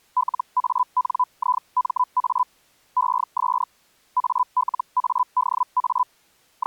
Hellschreiber (Feld-Hell, 122.5 baud), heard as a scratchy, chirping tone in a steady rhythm, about 1000 Hz. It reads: LANIMA ES ALADA …